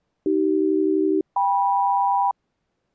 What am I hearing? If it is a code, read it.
Aircraft SELCAL, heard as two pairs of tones. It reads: AC-KM